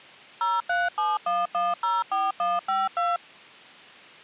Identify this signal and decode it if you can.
DTMF, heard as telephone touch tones, dialled by machine, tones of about 190 ms. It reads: 0371104152